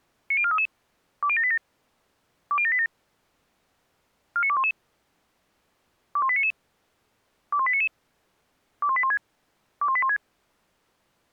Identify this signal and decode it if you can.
Five-tone selective call (ZVEI), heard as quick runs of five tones, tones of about 70 ms. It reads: 90433 20787 20787 49211 21899 21899 21816 21816